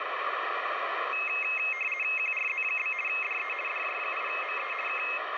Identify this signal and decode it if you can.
RTTY (50 baud, 450 Hz shift), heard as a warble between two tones, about 2350 Hz centre, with radio static. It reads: QRZ? DE DJ8ME K